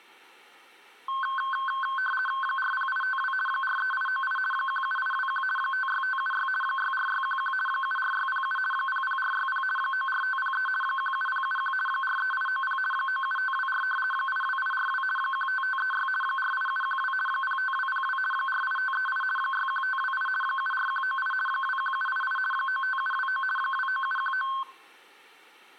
RTTY (50 baud, 450 Hz shift), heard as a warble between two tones, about 1300 Hz centre. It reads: 40852 43898 17821 56576 64611 74607 00460 94503 17071 43890 97524 82842 15536 48712 05202 48538 61528 74198 21788 95729 29719